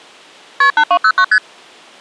Multi-frequency trunk signalling (R1, as on North American trunks), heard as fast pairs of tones, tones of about 70 ms. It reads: KP 8209 ST